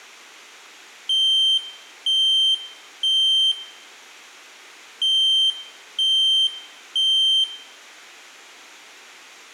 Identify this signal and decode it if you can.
Alarm pattern, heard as an alarm's beeps, played twice, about 3150 Hz, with room echo. Temporal three. Smoke or fire, evacuate.